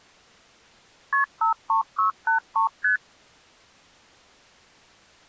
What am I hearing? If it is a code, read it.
Multi-frequency trunk signalling (R1, as on North American trunks), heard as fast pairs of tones, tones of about 120 ms. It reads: KP 53683 ST